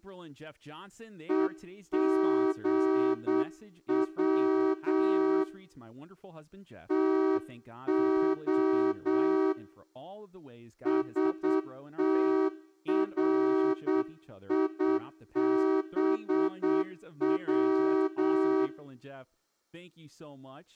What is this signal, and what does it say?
Morse code (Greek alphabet), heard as a horn, hand-sent with a straight key, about 8 wpm, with speech in English. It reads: ΕΓΩ ΤΟ ΣΤΡΙΒΩ